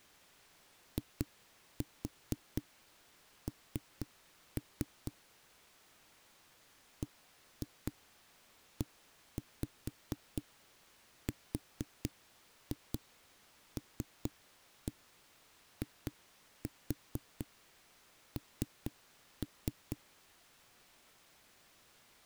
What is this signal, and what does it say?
Tap code, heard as knocks on a wall, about 4 knocks a second. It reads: IN BERLIN